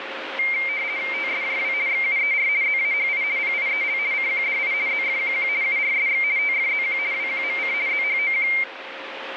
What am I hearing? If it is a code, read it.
RTTY (50 baud, 170 Hz shift), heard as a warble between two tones, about 2200 Hz centre, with radio static and a steady whistle near 540 Hz. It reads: TSJW XUER ZAHI PIEL CQDI ZFQQ URSX TFZQ WQMC ZHOQ